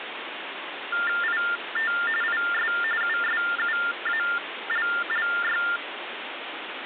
TTY/TDD text telephone tones (45.45 baud Baudot), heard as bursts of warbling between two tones, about 400 Hz shift, 1600 Hz centre, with phone line noise. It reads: IT IS USUALLY